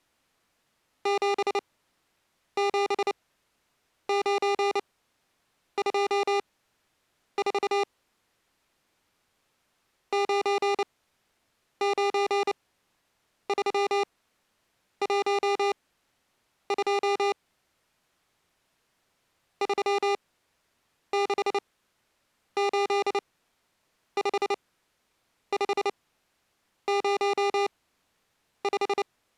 Morse code, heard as electronic beeps, machine-sent, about 29 wpm, spaced as for 8 wpm, 400 Hz. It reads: 77924 99312 3685505